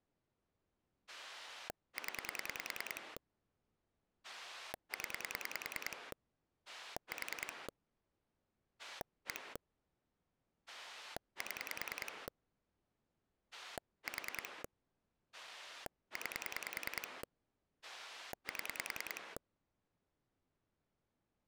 Pulse dialling, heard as a rotary dial, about 10 pulses a second. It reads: 0 0 4 1 7 4 9 7